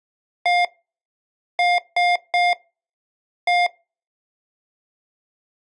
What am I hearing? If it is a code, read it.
Beep code, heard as beeps from a small speaker, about 710 Hz. 1-3-1. In Phoenix BIOS tables: memory refresh failure.